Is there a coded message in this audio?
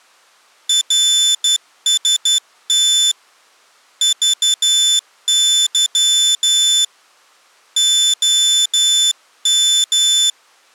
Yes: Morse code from 0.6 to 10.4 s, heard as a high beeper, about 12 wpm, 3500 Hz. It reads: RST VY OM